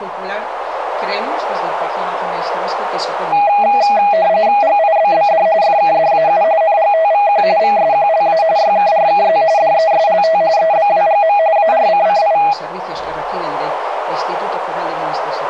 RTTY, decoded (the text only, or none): GIBBD FKDAU NGTVQ VSQLA YKRKZ DESLT EBWGM ARCCI